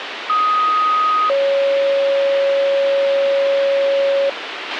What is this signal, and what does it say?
Two-tone page, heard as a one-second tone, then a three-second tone, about 1250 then 550 Hz, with radio hiss and a squelch burst at the end.